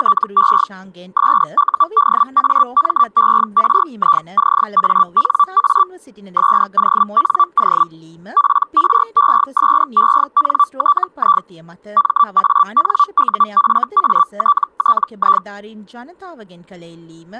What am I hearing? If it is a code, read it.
Hellschreiber (Feld-Hell, 122.5 baud), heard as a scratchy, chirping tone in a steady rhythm, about 1160 Hz. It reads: … SUDAMERICANA SONO PRESENTI MANUFATTI